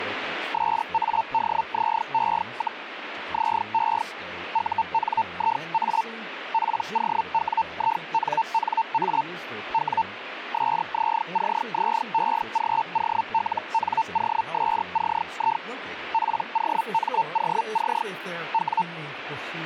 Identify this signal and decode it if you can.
Hellschreiber (Feld-Hell, 122.5 baud), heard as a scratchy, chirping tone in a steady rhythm, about 900 Hz, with radio static and speech in English. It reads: SADZE, ZE UNIA POWINNA W SZCZEGOLNOSCI POMOC W